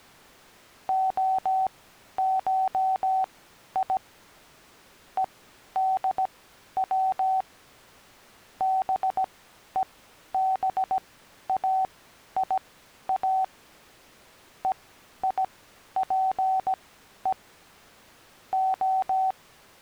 Morse code (Greek alphabet), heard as a keyed tone, machine-sent, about 17 wpm, spaced as for 11 wpm, 760 Hz. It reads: ΟΧΙ ΕΔΩ ΒΕΒΑΙΑ ΕΙΠΕ Ο